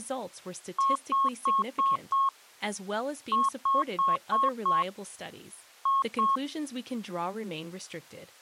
Beep code, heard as beeps, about 1090 Hz, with speech in English. 5-5-2.